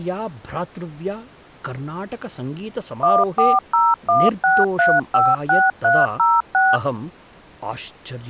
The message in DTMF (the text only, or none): 14016356306